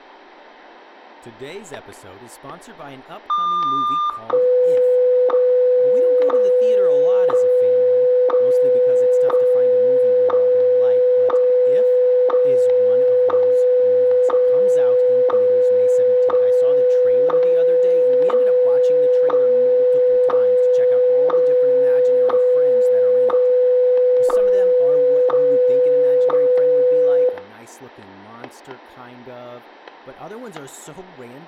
Radio time signal (WWVH, Hawaii), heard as ticks, one a second, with static crashes, room echo and speech in English.